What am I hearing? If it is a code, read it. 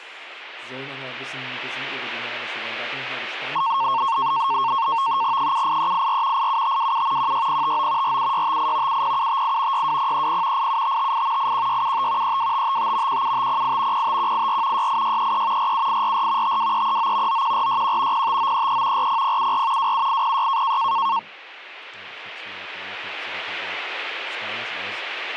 NAVTEX (SITOR-B), 100 baud, 170 Hz shift, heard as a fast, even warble, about 1000 Hz centre, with speech in German. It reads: 78384 87527 16059 47658 70758 62030 87558 81675 32555 17508 05184 68633 47844 52339 91461 05933 40074 27806